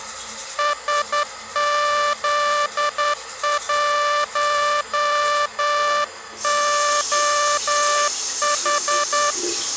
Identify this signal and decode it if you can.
Morse code, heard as a buzzer, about 10 wpm, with the noise of a restroom. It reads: SZ1OH